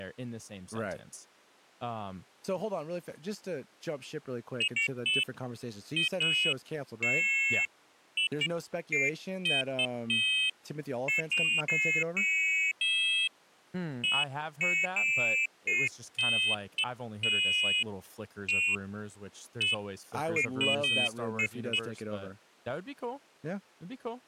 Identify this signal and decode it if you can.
Pairs of high tones at irregular times, with speech in English. There is no code.